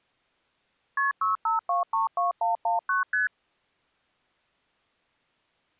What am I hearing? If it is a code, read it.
Multi-frequency trunk signalling (R1, as on North American trunks), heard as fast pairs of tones, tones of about 140 ms. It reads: KP 65232119 ST